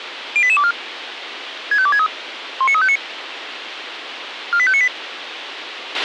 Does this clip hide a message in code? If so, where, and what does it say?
Yes: five-tone selective call (ZVEI) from 0.4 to 4.9 s, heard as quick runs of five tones, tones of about 70 ms, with radio hiss and a squelch burst at the end. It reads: 08824 65263 19359 48598